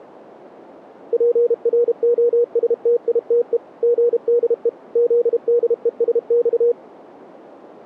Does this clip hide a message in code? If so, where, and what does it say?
Yes: Morse code (Russian alphabet) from 1.1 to 6.8 s, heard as a keyed tone, machine-sent, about 32 wpm, 480 Hz. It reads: ПРОСТИТЕ ГДЕ ЗДЕСЬ